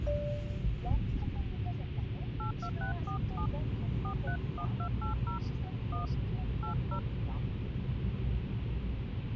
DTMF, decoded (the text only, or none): 82647 431280 1 80